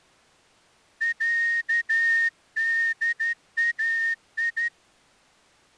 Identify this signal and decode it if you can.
Morse code (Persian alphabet), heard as a whistle, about 12 wpm. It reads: صدای